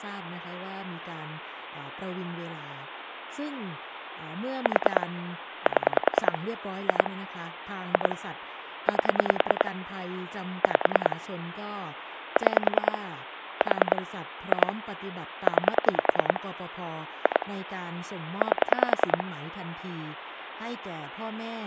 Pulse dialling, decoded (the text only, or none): 4 7 2 2 8 5 6 4 2 9 2 8